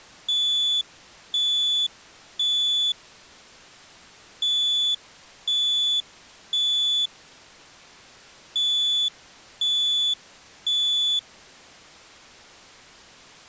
Alarm pattern, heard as an alarm's beeps, played three times, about 3450 Hz. Temporal three. Smoke or fire, evacuate.